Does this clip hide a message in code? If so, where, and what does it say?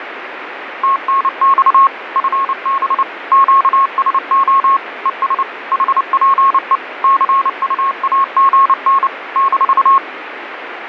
Yes: Morse code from 0.8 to 10.0 s, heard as a keyed tone, machine-sent, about 29 wpm, 1090 Hz, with radio static. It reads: TNX FB QSO ES HPE CUAGN -